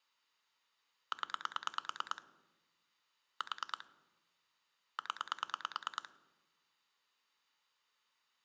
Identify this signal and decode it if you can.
Pulse dialling, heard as clicks on a phone line, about 9 pulses a second. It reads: 0 4 0